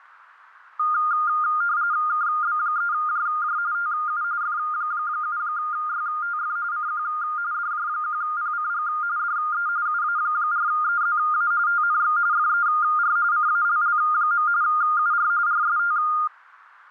RTTY (45.45 baud, 170 Hz shift), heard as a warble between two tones, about 1320 Hz centre. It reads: KB3JJ TU F7YTF CQ DJ1PCG DE UA4EZA TNX FER CALL. UR RST